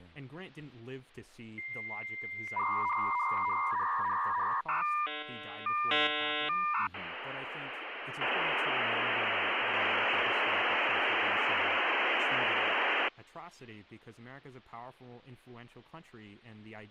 Dial-up modem handshake (V.34 or later), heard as a whistle, warbles, then hiss, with speech in English.